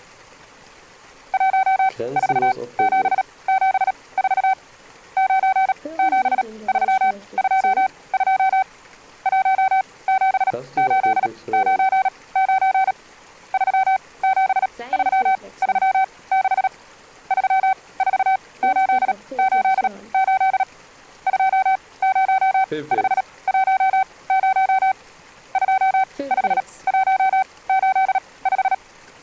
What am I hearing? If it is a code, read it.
Morse code, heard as a keyed tone, machine-sent, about 37 wpm, spaced as for 22 wpm, 760 Hz. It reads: 14774 97322 17899 37336 34888 20510 25185